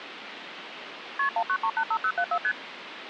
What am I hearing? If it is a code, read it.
Multi-frequency trunk signalling (R1, as on North American trunks), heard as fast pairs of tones, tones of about 70 ms, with phone line noise. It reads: KP 19385074 ST